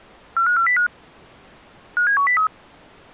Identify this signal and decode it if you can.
Five-tone selective call (CCIR), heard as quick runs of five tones, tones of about 100 ms. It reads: 45405 57103